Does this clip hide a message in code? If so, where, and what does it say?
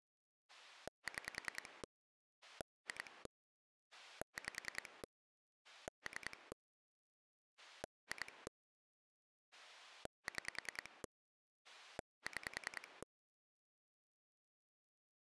Yes: pulse dialling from 0.5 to 13.0 s, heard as a rotary dial, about 10 pulses a second. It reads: 6 2 5 3 2 6 6